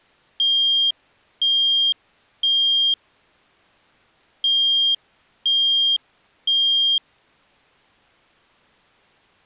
Alarm pattern, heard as an alarm's beeps, played twice, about 3200 Hz. Temporal three. Smoke or fire, evacuate.